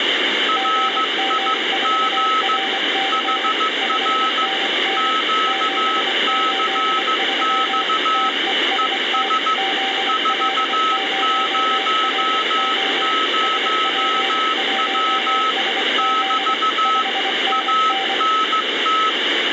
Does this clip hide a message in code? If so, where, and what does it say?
Yes: Morse code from 0.4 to 19.2 s, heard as two keyed tones, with radio static. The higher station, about 15 wpm, 1290 Hz: RIG HR QCX ES 400W <BT> ANT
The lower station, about 24 wpm, 780 Hz: GM4RC 5NN 783 TEST ZL0RO SP1SZ 5NN